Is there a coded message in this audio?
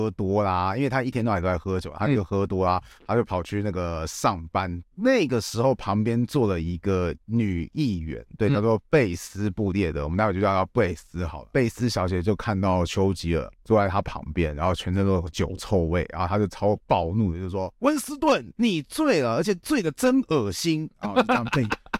No, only speech in Chinese.